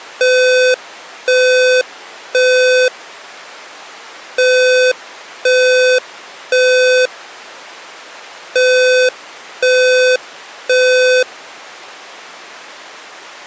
Alarm pattern, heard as an alarm's beeps, played three times, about 510 Hz. Temporal three. Smoke or fire, evacuate.